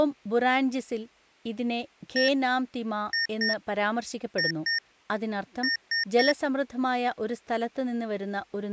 Beep code, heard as beeps from a small speaker, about 1850 Hz, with speech in Malayalam. 1-2-2-3. In Phoenix BIOS tables: BIOS ROM checksum failure.